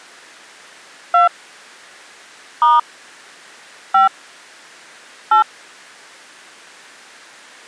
DTMF, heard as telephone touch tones, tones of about 160 ms. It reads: 2 * 5 8